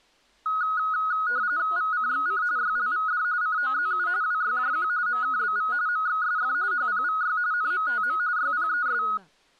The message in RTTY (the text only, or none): VCXC YLVD COZU WYJQ MKBV MXSF HPVY NMTM YPES